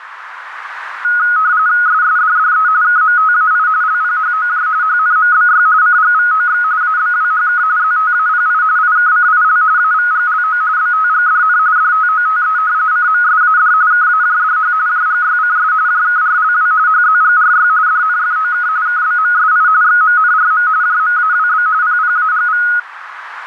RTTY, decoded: SSDDE KMTAI LPHOJ HNMBY CGVOX ABWHK ZTAPI IKCIL AVGLO BTGDN DTOTE CMSAD KAJDH JGYCS JKRLW HZGRY DNFOK KBMSI XMNRM JMAWB PPAGV

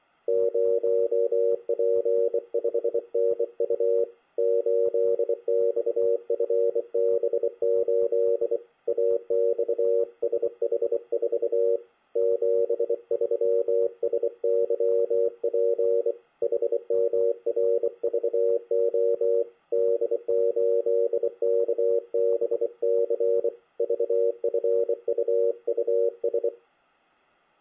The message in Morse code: 0P5NU 8XFB8 AXSH4 73SYP HMRVO D8KBC VFUUS

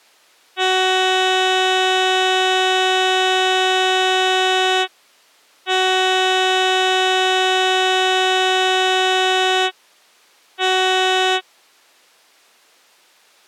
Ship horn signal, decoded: 2 long, 1 short

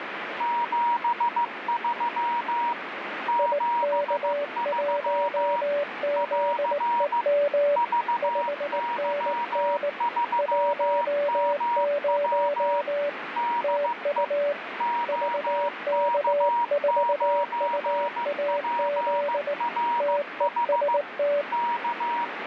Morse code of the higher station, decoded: 73 73 <AR> VY3MW DE OK9PRH K

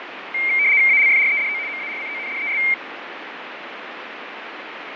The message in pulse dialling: none

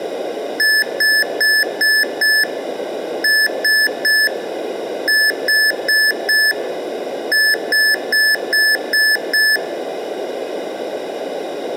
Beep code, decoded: 5-3-4-6

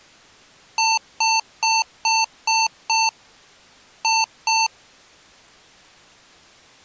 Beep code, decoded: 6-2

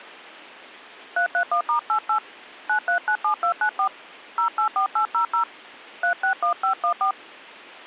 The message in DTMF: 331*88 9397294 084800 361514

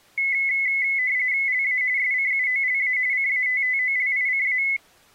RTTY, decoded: LA SCUOLA CATTOLICA

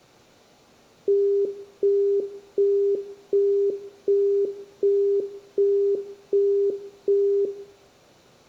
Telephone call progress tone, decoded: busy tone

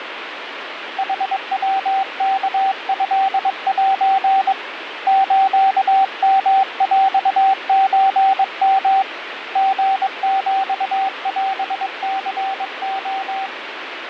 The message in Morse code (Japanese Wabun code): ヌヤワトセ スヨヰソヨ リヒオニレ

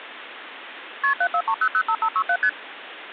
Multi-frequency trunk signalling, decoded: KP 743005567 ST

